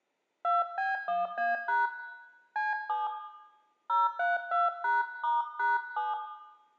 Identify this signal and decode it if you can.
DTMF, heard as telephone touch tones, dialled by hand, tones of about 180 ms, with room echo. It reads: 2B1A# C7 032#*#7